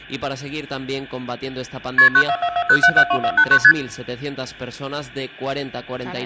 Multi-frequency trunk signalling (R1, as on North American trunks), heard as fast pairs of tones, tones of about 70 ms, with hum. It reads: KP 94440772489 ST